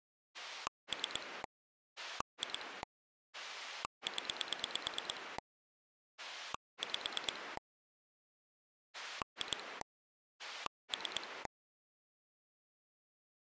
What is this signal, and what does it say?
Pulse dialling, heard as a rotary dial, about 9 pulses a second. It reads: 3 2 0 5 2 3